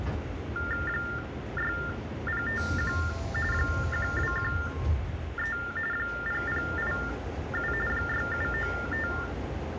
TTY/TDD text telephone tones (45.45 baud Baudot), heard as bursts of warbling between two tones, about 400 Hz shift, 1600 Hz centre, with phone line noise and the noise inside a subway train. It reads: 6051 1213 0087 6795